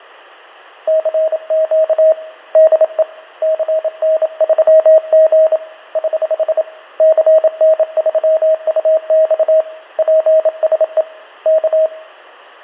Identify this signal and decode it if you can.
Morse code, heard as a keyed tone, hand-sent with a bug key, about 27 wpm, 630 Hz, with fading and room echo. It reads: CQ DE CN3G <HH> CN3UX PSE K